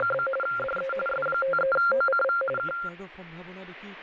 RTTY (45.45 baud, 850 Hz shift), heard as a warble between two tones, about 960 Hz centre, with radio static and speech in Assamese. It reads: … DE S53OCV K